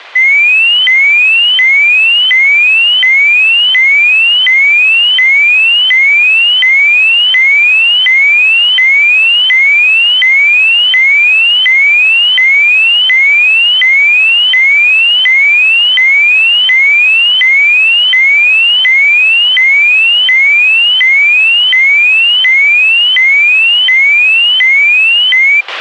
A tone that sweeps in pitch again and again, with a squelch burst at the end. There is no code.